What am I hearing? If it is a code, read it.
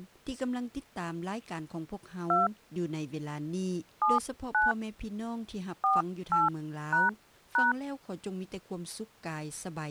DTMF, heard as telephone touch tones, dialled by hand, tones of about 170 ms. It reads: 2 79 48##